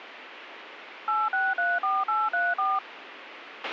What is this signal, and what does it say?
DTMF, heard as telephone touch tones, dialled by machine, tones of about 210 ms, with radio hiss and a squelch burst at the end. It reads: 8634834